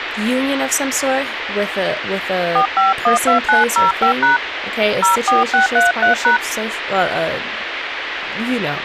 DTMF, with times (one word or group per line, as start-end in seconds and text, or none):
2.6-4.4 4512905#
5.0-6.4 04633#